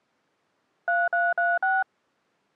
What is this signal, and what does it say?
DTMF, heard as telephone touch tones, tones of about 200 ms. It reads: 3336